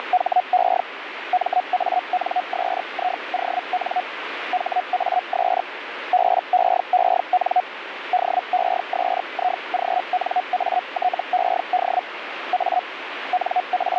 Hellschreiber (Feld-Hell, 122.5 baud), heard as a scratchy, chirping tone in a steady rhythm, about 730 Hz, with radio static. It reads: … MANSION HAS BEEN DESIGNATED A …